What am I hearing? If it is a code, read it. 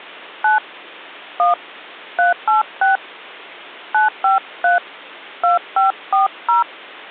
DTMF, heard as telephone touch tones, dialled by hand, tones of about 140 ms. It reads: 9 1 386 953 2540